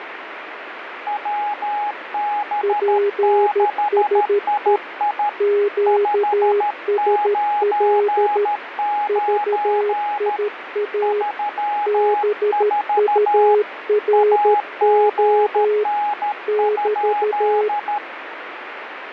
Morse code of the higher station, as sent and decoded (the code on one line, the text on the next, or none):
.-- -... -.... .. .. / ..... ----. ----. / ...-- ....- / .- --. -. ..--..
WB6II 599 34 AGN?